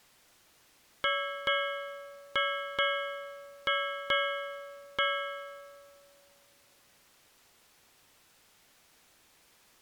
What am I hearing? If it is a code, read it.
Ship's bell, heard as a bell. 7. Seven half-hours of the watch have passed.